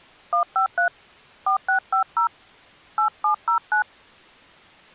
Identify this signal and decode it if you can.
DTMF, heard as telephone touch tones, dialled by hand, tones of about 100 ms. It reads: 153 4650 8709